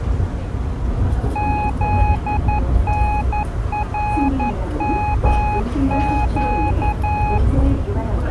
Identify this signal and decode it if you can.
Morse code (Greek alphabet), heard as a keyed tone, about 11 wpm, 840 Hz, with the noise inside a subway train. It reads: ΖΝΡΜΨ